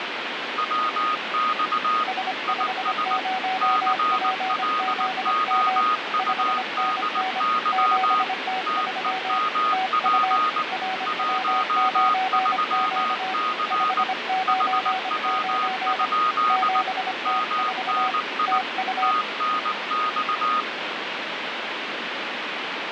Morse code, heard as two keyed tones, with heavy radio static. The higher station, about 19 wpm, 1240 Hz: WX IS CLOUDY TEMP 13C HW? MNI TNX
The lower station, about 25 wpm, 750 Hz: S50PZM 5NN 7T3 TU RW9Q 599 7T4 TU